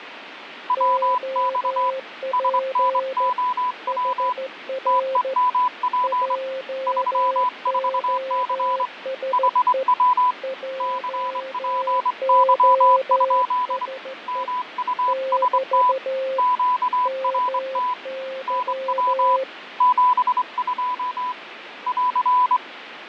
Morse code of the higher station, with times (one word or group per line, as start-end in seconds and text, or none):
0.7-1.9 WX
2.3-4.3 SNOW
4.9-6.4 TEMP
6.9-8.9 34C
9.3-10.3 HW
10.8-13.9 CPY?
14.3-15.9 MUST
16.4-17.9 QRT
18.5-19.4 NW
19.8-21.3 72
21.9-22.6 <AR>